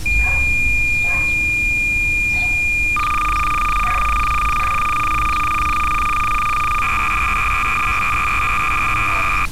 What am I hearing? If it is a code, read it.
Cassette data (Kansas City type), 300 baud, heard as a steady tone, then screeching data, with street noise.